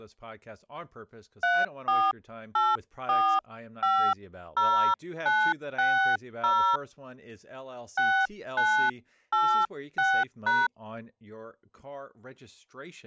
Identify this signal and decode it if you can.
DTMF, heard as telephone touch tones, dialled by hand, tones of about 280 ms, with speech in English. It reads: 348450960 6986#